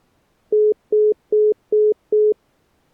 Telephone call progress tone (single-tone plan, as in most of Europe), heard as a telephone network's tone, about 420 Hz, 0.2 s on and 0.2 s off. Congestion tone.